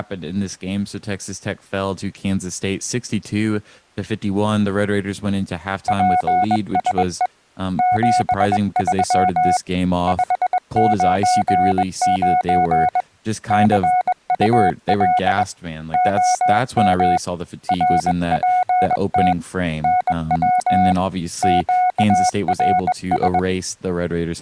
Morse code, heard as a keyed tone, hand-sent with a bug key, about 21 wpm, 730 Hz, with speech in English. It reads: PSE 73 599 CUL OM RPT NW QRS